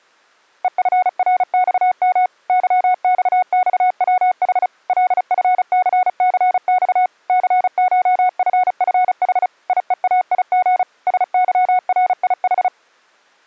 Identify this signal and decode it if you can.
Morse code (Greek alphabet), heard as a keyed tone, machine-sent, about 35 wpm, 730 Hz. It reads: ΕΦΡΞΜ ΥΞΞΩΗ ΛΦΘΘΞ ΘΧΦΦΗ ΙΕΑΙΓ ΣΥΡΙΗ